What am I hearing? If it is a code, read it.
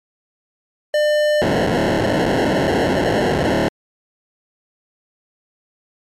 POCSAG pager data (1200 baud), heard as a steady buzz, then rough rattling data.